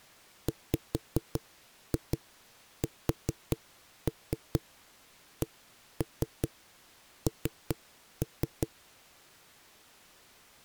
Tap code, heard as knocks on a wall, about 4 knocks a second. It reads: WSCN